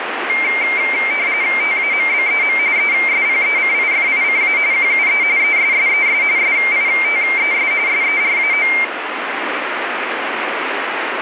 RTTY (45.45 baud, 170 Hz shift), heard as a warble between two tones, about 2200 Hz centre, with radio static. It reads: TAMBEM ESPECIFICA QUE ESSES SITES SERAO